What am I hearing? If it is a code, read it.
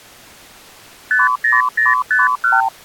Multi-frequency trunk signalling (R2, with the far end's replies), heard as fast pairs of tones, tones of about 170 ms. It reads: 50051